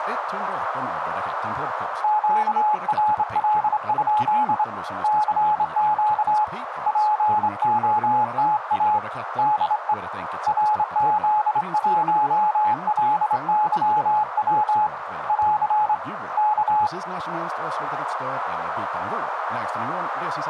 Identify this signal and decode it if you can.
Morse code, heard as a keyed tone, hand-sent with a straight key, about 26 wpm, 850 Hz, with radio static, a narrow filter and speech in Swedish. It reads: QRL? CQ POTA DE RZ1LYW <AR> K